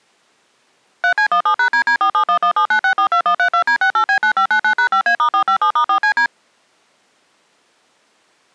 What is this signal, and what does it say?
DTMF, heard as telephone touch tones, dialled by machine, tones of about 90 ms. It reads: 3C17#DD471179642132D68B9599#5A*457*4CD